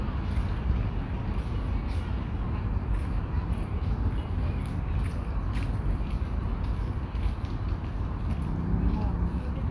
The noise of a park. There is no code.